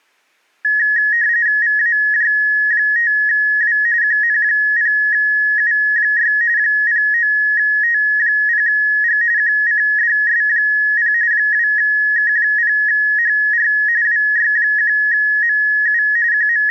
RTTY (45.45 baud, 170 Hz shift), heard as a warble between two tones, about 1800 Hz centre. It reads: VAJ5W QN0U6 09T0G QCDS0 2K0HR WY1MU …